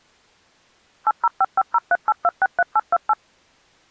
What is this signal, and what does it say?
DTMF, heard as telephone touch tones, dialled by machine, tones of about 40 ms. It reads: 8055038263828